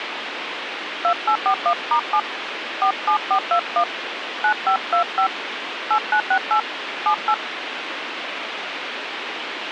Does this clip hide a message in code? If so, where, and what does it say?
Yes: DTMF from 1.0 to 7.3 s, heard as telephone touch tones, dialled by hand, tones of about 80 ms, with radio hiss. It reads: 2841*7 47421 9525 8968 78